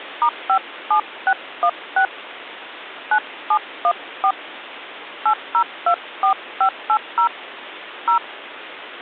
DTMF, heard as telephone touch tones, dialled by hand, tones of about 80 ms, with phone line noise. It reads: *57616 9714 8024580 0